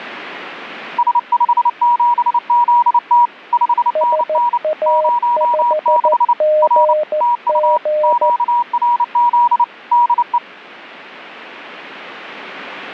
Morse code, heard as two keyed tones. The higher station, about 29 wpm, 960 Hz: S57ZT 5NN 06 R TU QRZ DE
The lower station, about 14 wpm, 610 Hz: SA5GG